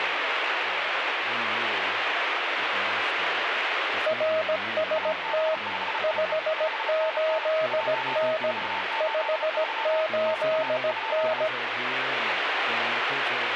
Morse code, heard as two keyed tones, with radio static. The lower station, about 17 wpm, 630 Hz: RST 58N 58N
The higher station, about 34 wpm, 890 Hz: AB5IE 5NN 1483 NR?